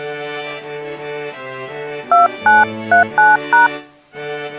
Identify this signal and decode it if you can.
DTMF, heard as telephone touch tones, dialled by hand, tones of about 160 ms. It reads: 2939#